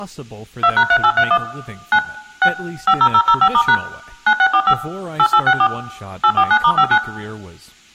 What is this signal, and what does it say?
DTMF, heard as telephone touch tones, dialled by machine, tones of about 70 ms, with room echo and speech in English. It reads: 2#3831 9 6 50005*# 9645 8864 849*59